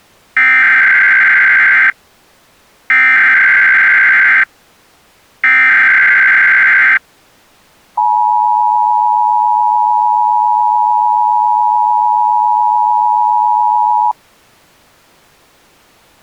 Emergency Alert System (SAME) tones (header bursts, then the 853 and 960 Hz attention tone), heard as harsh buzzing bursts, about 520.83 baud.